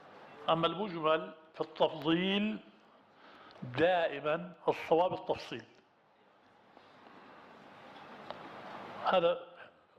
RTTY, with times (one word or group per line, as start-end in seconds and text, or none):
none